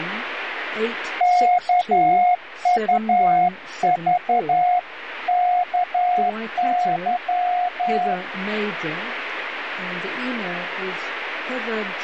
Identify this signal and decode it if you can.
Morse code (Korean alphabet), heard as a keyed tone, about 11 wpm, 720 Hz, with radio static. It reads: 일에